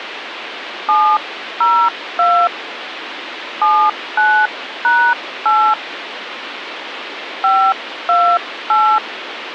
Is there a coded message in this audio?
Yes: DTMF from 0.9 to 9.0 s, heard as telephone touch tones, dialled by hand, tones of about 280 ms, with phone line noise. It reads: 702 79#8 528